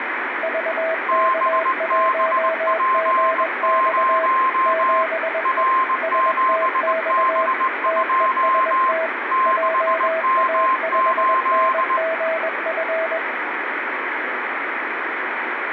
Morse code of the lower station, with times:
0.4-4.3 VK1GX
4.7-5.6 7E
6.0-7.5 STX
7.9-9.1 TEST
9.5-13.2 JA5NGF

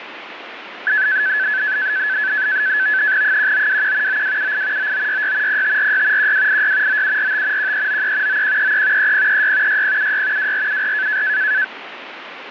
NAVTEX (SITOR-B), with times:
3.2-4.2 1921
4.1-4.9 9278
4.8-5.6 9966
5.5-6.3 0546
6.2-7.0 1286
6.9-7.7 9745
7.6-8.4 1393
8.3-9.1 9133
9.0-9.8 3036
9.7-10.5 6076
10.4-11.2 2474

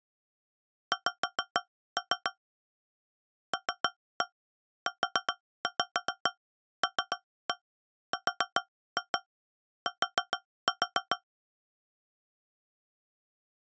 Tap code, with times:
0.9-2.3 X
3.5-11.2 LULRT

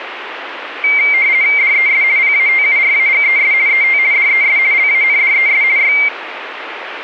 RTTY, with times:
1.6-2.0 DES
2.2-3.5 PATURAGES
3.7-4.0 ET
4.1-4.6 DES
4.7-5.6 LANDES
5.8-5.9 Y

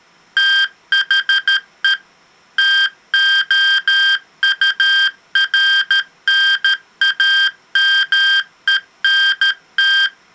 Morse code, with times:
0.4-1.9 THE
2.6-10.1 TOURNAMENT

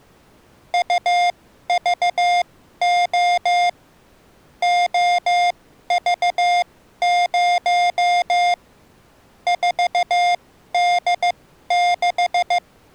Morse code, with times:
0.7-3.7 UVO
4.6-8.5 OV0
9.5-12.6 4D6

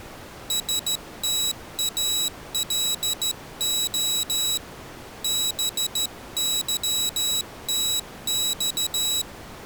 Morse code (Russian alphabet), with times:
0.5-4.6 СТАЛО
5.2-9.2 БЫТЬ

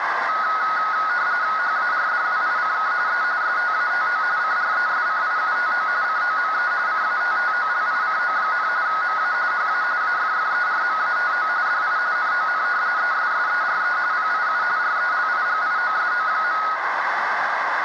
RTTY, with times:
1.6-2.9 HARDWICK
3.1-3.2 E
3.4-4.2 STATO
4.4-5.9 CRESCIUTO
6.0-6.7 COME
6.9-8.7 CATTOLICO,
8.9-9.3 MA
9.5-9.8 HA
10.0-11.5 AFFERMATO
11.7-12.0 DI
12.2-12.6 NON
13.0-14.0 ESSERE
14.1-14.6 PIU
14.8-16.6 RELIGIOSO.

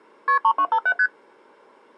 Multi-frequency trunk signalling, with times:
0.3-0.4 KP
0.4-0.9 3257
1.0-1.1 ST

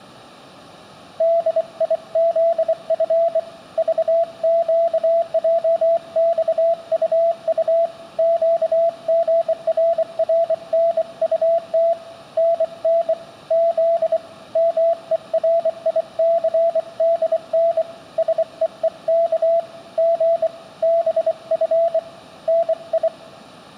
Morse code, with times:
1.2-3.4 DIZF
3.8-7.9 VQJXUU
8.2-11.9 QGRRNUT
12.4-13.1 NN
13.5-14.2 Z
14.6-17.8 MERICDN
18.2-19.6 SEEK
20.0-20.5 G
20.8-22.0 BF
22.5-23.1 NI

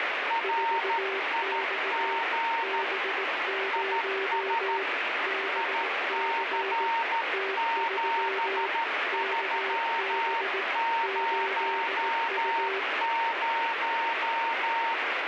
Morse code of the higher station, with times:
0.3-2.8 RIG
3.7-4.8 IS
5.6-14.9 IC7300

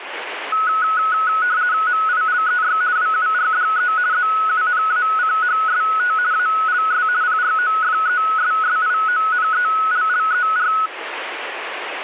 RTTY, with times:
1.9-2.8 MILEY
3.0-3.9 WURDE
4.1-6.1 ZUNACHST
6.3-7.1 ALS
7.2-10.7 PROFESSIONELLER

